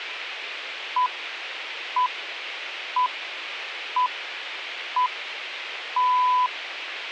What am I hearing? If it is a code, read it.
Radio time signal (six pips, as the Greenwich Time Signal), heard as pips, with a squelch burst at the end.